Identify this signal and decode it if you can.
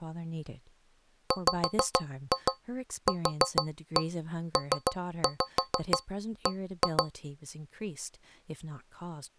Tap code, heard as taps on a metal pipe, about 6 knocks a second, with speech in English. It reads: WQPB